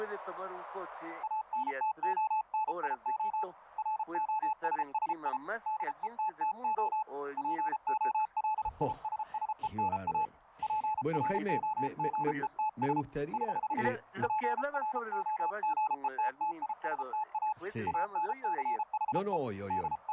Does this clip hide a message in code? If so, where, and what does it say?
Yes: Morse code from 1.2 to 20.1 s, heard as a keyed tone, hand-sent with a paddle, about 33 wpm, 860 Hz, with radio static. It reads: ANTONIO ROSSI DETTO POLISSENA PROGETS <HH> PROGETTISTA ANCHE …